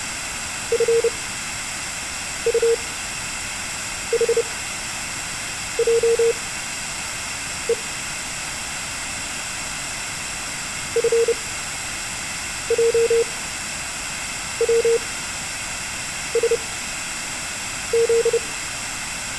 Morse code, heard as a keyed tone, machine-sent, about 30 wpm, spaced as for 6 wpm, 460 Hz. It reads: FUHJE FJWSZ